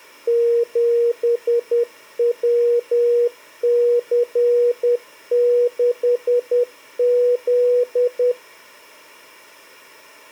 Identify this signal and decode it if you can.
Morse code, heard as a keyed tone, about 10 wpm, 480 Hz. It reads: 7WC6Z